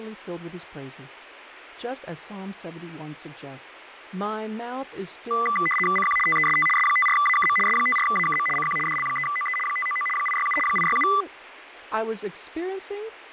RTTY (75 baud, 850 Hz shift), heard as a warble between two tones, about 1600 Hz centre, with radio static and speech in English. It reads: CQ TEST S54AKM S54AKM CQ DL3OE 599 867 867